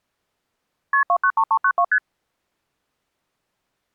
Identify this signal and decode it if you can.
Multi-frequency trunk signalling (R1, as on North American trunks), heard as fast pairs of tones, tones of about 70 ms. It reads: KP 293392 ST